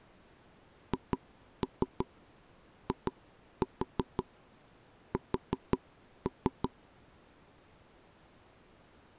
Tap code, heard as taps on a table, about 5 knocks a second. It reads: HIS